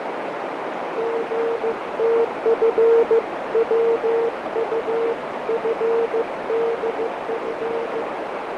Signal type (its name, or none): Morse code